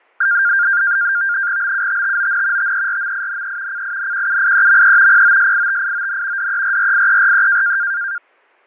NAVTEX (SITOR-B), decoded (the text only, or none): BUTTON TERMINE CINQUIEME POSITION DERRIERE